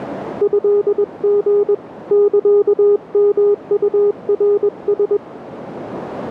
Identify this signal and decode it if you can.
Morse code (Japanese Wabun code), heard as a keyed tone, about 21 wpm, 410 Hz, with radio static. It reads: トリ サヨウナラ